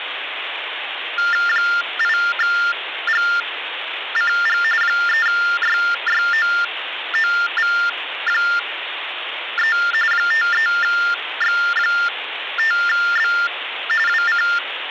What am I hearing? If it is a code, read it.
TTY/TDD text telephone tones (45.45 baud Baudot), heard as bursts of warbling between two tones, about 400 Hz shift, 1600 Hz centre, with phone line noise. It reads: 8GCG 3YYOOV3 53X5B WC